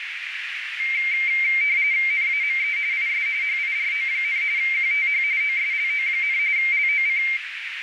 RTTY (45.45 baud, 170 Hz shift), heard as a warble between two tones, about 2200 Hz centre, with radio static and a narrow filter. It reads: NAME IS HIRO, QTH OSLO, LOC